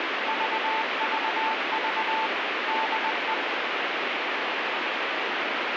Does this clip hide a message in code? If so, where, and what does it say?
Yes: Morse code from 0.2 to 3.4 s, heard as a keyed tone, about 20 wpm, 880 Hz, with heavy radio static. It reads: VVV DE